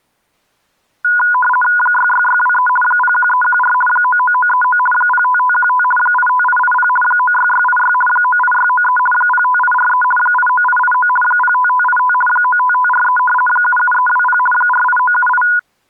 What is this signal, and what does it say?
RTTY (50 baud, 450 Hz shift), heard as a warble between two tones, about 1230 Hz centre. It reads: 66623 01314 99939 05515 85880 96686 98693 05843 89889 05585 95543 77320 48978